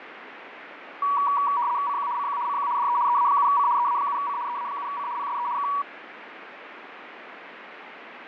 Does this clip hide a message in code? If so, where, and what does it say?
Yes: RTTY (75 baud, 170 Hz shift) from 1.0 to 5.8 s, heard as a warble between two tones, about 1050 Hz centre, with radio static and fading. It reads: CQ CQ CQ DE EA7C EA7C EA7C PSE K